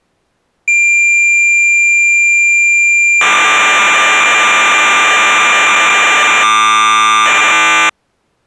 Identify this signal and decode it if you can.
Cassette data (Kansas City type), 1200 baud, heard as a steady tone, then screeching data.